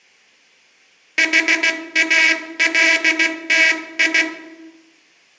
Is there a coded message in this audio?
Yes: Morse code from 1.1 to 4.3 s, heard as a buzzer, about 16 wpm, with room echo. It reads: HALTI